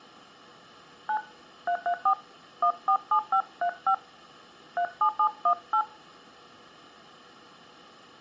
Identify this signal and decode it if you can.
DTMF, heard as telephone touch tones, dialled by hand, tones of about 80 ms. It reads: 9 334 147535 37718